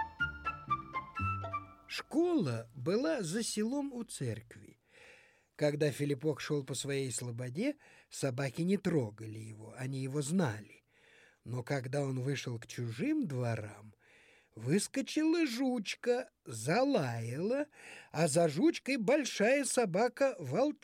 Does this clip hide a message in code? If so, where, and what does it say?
No.